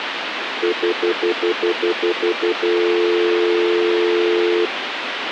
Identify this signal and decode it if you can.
Telephone call progress tone (North American plan), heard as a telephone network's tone, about 350, 440 Hz, 0.1 s on and 0.1 s off, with phone line noise. Stutter dial tone.